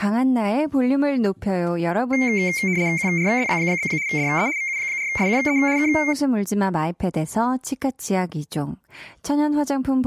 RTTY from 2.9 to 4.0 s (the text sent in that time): QRZ?